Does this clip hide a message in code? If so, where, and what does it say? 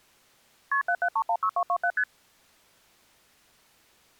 Yes: multi-frequency trunk signalling (R1, as on North American trunks) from 0.7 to 2.0 s, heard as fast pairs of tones, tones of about 70 ms. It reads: KP 77316227 ST